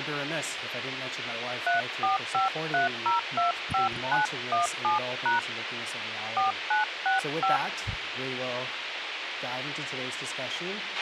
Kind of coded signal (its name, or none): DTMF